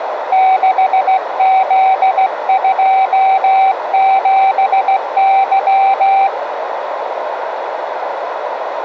Morse code, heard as a keyed tone, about 16 wpm, 770 Hz, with radio static and a narrow filter. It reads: 6Z27Y